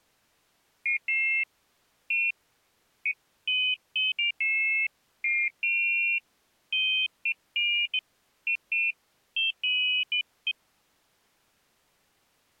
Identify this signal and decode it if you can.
Pairs of high tones at irregular times. There is no code.